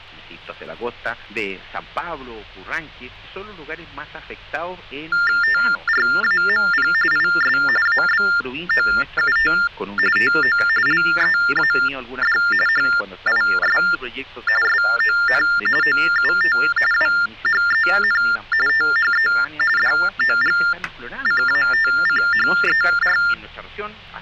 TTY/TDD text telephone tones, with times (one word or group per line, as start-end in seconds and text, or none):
5.4-6.9 TRAMP
7.1-7.6 IS
7.9-9.5 ABOUT
10.2-10.6 TO
10.9-12.4 LEAD
12.7-13.8 HIS
14.6-15.4 SON
15.8-16.6 OUT
16.9-18.2 WHEN
18.7-19.3 THE
19.8-23.2 DOGCATCHER